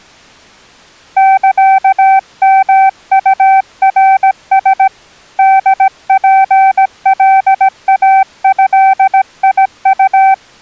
Morse code (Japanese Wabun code), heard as a keyed tone, hand-sent with a paddle, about 17 wpm, 770 Hz. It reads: サヨウナラ ホツカイドウ